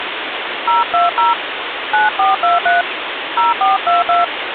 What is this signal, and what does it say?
DTMF, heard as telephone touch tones, dialled by hand, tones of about 160 ms, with phone line noise. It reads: 020 9423 0422